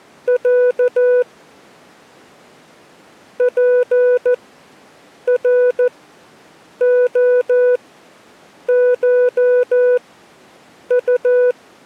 Morse code (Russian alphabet), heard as a keyed tone, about 14 wpm, spaced as for 7 wpm, 500 Hz. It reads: Я ПРОШУ